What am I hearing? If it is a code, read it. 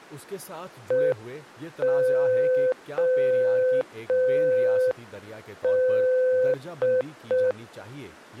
Morse code (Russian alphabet), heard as a keyed tone, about 5 wpm, 510 Hz, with speech in Urdu. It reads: ЕОД